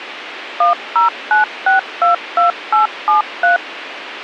DTMF, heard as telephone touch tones, dialled by machine, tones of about 130 ms, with radio hiss and a squelch burst at the end. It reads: 109622873